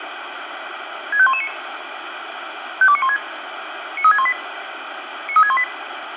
Five-tone selective call (ZVEI), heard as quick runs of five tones, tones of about 70 ms, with radio hiss. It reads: 65119 52916 93618 93618